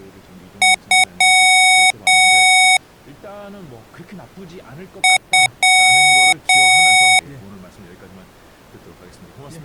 Beep code, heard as beeps from a small speaker, played twice, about 740 Hz, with speech in Korean. 2 short, 2 long.